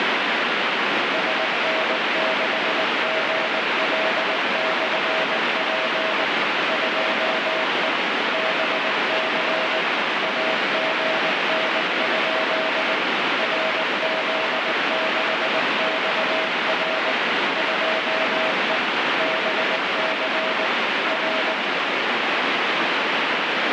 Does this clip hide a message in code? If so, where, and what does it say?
Yes: Morse code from 1.1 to 21.6 s, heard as a keyed tone, machine-sent, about 19 wpm, 640 Hz, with heavy radio static. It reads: SN6GL/P 2E BC AGN? RZ6XR 2E BC R